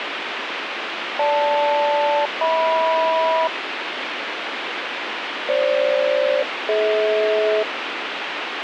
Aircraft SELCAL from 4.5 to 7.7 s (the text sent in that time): FG-DH